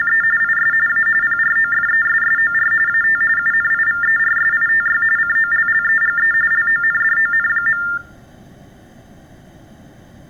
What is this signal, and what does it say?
TTY/TDD text telephone tones (45.45 baud Baudot), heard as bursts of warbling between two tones, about 400 Hz shift, 1600 Hz centre. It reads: … IS A PROFESSOR AT UNIVERSITY COLLEGE LONDON.